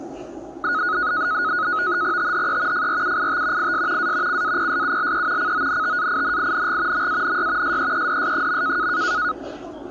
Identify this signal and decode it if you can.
NAVTEX (SITOR-B), 100 baud, 170 Hz shift, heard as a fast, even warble, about 1360 Hz centre, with the noise of a park. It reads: THE FRUIT IS A CAPSULE CONTAINING MANY SEEDS.